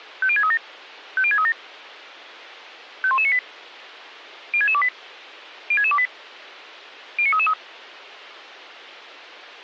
Five-tone selective call (ZVEI), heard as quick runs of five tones, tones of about 70 ms. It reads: 50637 50637 51198 06628 06628 09333